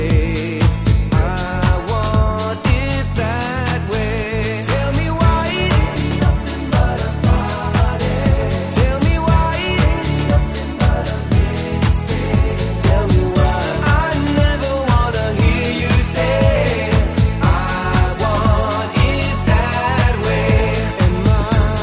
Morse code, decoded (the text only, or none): none